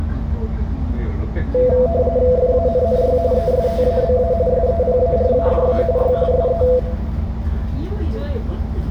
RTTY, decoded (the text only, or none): FANNY ESTABA SEPARADA Y SE